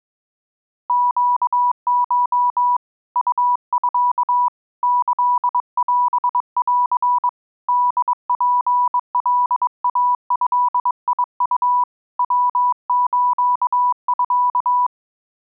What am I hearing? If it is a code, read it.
Morse code (Japanese Wabun code), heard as a keyed tone, hand-sent with a bug key, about 22 wpm, 980 Hz. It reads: ネコ ウミ キオン ホツカイドウ ヤスミ